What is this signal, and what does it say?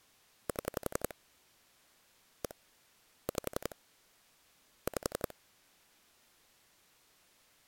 Pulse dialling, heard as clicks on a phone line, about 11 pulses a second. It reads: 7 1 5 5